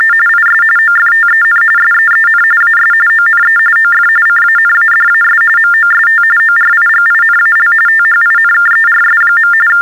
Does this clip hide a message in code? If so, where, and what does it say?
Yes: TTY/TDD text telephone tones (45.45 baud Baudot) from 0.0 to 9.8 s, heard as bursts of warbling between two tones, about 400 Hz shift, 1600 Hz centre. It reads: … IS OFTEN SEEN AS ONE OF CANADAS MOST ORIGINAL THINKERS. …